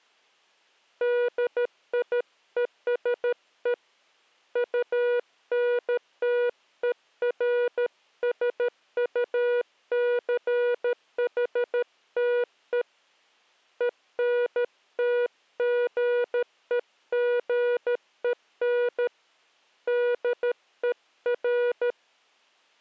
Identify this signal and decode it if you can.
Morse code, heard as a keyed tone, hand-sent with a paddle, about 13 wpm, 480 Hz. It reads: DIESE UNTERSUCHTE ENTGEGEN DER